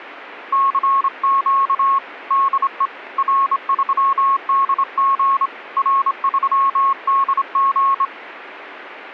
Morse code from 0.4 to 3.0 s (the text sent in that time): CQ DE